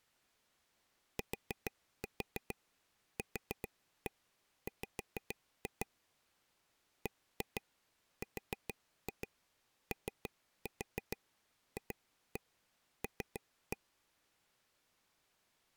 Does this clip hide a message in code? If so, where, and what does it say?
Yes: tap code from 1.2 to 13.8 s, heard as taps on a table, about 6 knocks a second. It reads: TQW BROFL